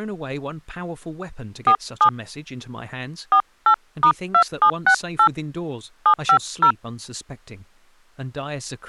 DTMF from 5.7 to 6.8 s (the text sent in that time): 750